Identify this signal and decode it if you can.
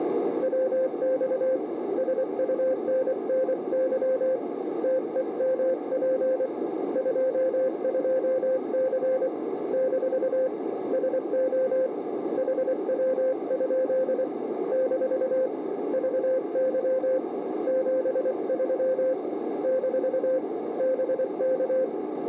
Morse code, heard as a keyed tone, hand-sent with a paddle, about 24 wpm, 520 Hz, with radio static and a narrow filter. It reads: WX SUNNY TEMP 22C - SO HW? - VY 73 - BK